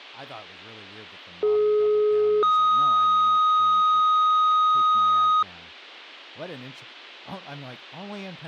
Two-tone page, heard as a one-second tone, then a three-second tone, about 420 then 1250 Hz, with speech in English.